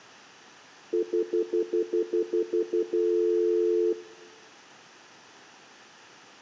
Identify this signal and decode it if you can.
Telephone call progress tone (North American plan), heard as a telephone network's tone, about 350, 440 Hz, 0.1 s on and 0.1 s off. Stutter dial tone.